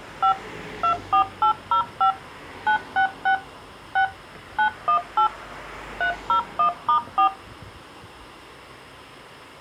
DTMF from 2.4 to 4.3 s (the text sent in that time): 966 6